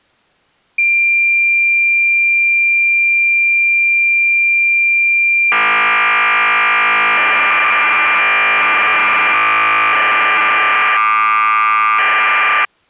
Cassette data (Kansas City type), 1200 baud, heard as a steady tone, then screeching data.